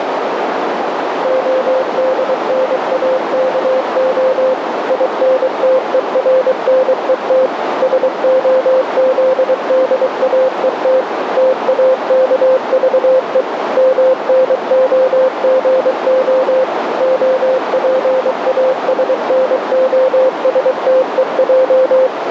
Morse code (Russian alphabet), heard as a keyed tone, machine-sent, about 23 wpm, 520 Hz, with heavy radio static and a narrow filter. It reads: ОДНАКО ИНТЕРНЕТ СОЗДАЕТ ТАКЖЕ МНОГО ОПАСНОСТЕЙ